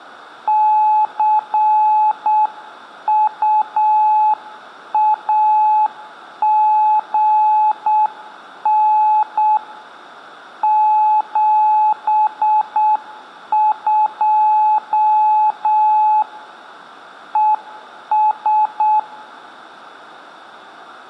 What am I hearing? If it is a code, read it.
Morse code, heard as a keyed tone, hand-sent with a paddle, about 7 wpm, 860 Hz, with room echo. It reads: CUAGN 72 ES